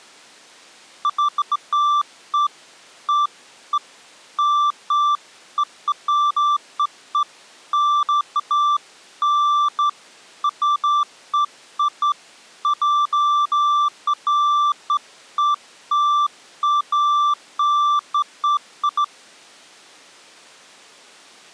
Beeps of irregular length. There is no code.